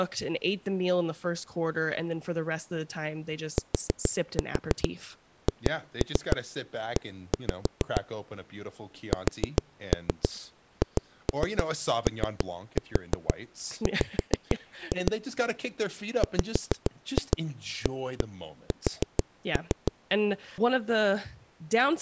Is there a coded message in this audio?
Yes: tap code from 3.6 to 19.9 s, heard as knocks on a wall, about 6 knocks a second, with speech in English. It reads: THE SHOW WAS